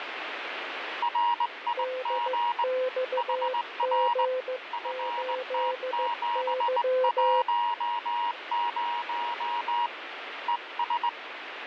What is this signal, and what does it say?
Morse code, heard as two keyed tones, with radio static. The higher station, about 19 wpm, 950 Hz: RIG HR FT710 ES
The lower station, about 15 wpm, 510 Hz: DXG8Y